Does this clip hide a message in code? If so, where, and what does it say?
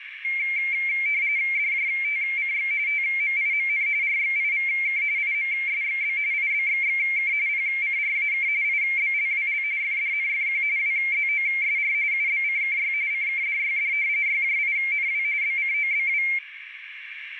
Yes: RTTY (45.45 baud, 170 Hz shift) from 0.2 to 16.4 s, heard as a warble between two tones, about 2200 Hz centre, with radio static and a narrow filter. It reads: DJTCX TMIMN RXIVK IMSXB IBXXK PCRAK IBLWL FDNFQ WZOSR UBCKY CKDYD YJINW BCOBW